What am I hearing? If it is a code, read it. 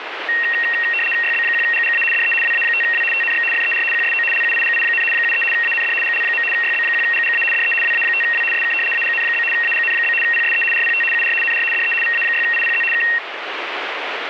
RTTY (75 baud, 850 Hz shift), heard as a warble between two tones, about 2300 Hz centre, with radio static. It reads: YB1GGA DE WA5W TNX FER QSO LUIGI, 73 AND GL. YB1GGA DE WA5W SK AGN? AGN? PSE RPT UR NR DE VA6IPZ K